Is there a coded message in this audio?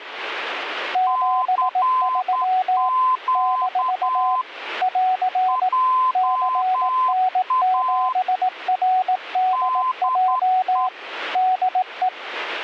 Yes: Morse code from 0.9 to 12.1 s, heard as two keyed tones, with radio static. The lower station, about 18 wpm, 740 Hz: 73 - <AR> CN7RDJ DE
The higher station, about 10 wpm, 1030 Hz: CQ JA DE